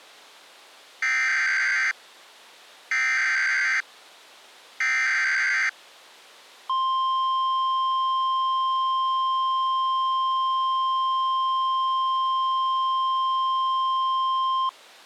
Emergency Alert System (SAME) tones (header bursts, then the 1050 Hz attention tone), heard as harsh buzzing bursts, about 520.83 baud.